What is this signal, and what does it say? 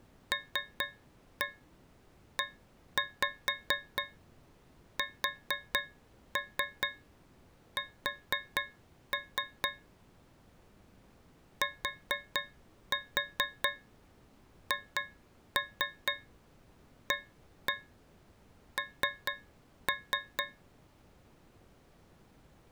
Tap code, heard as taps on a metal pipe, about 4 knocks a second. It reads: LESS THAN